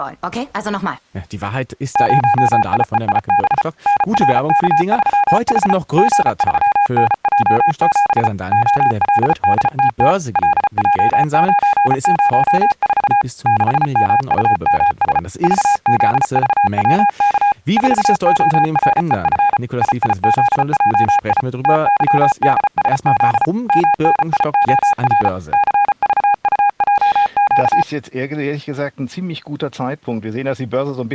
Morse code, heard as a keyed tone, machine-sent, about 34 wpm, 820 Hz. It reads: 0IEIB NRK3H G3NJ7 OLDTT LJ904 6MUMS VZVWK 4OREF IIZJI TYDSZ MNIOR CVUJQ